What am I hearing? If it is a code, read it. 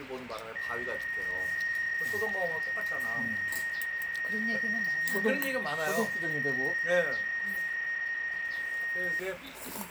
PSK63 (62.5 baud), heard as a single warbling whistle, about 1850 Hz, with radio static and the noise of a restaurant.